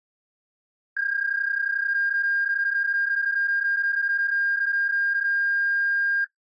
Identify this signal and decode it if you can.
PSK31 (31.25 baud), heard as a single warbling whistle, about 1600 Hz.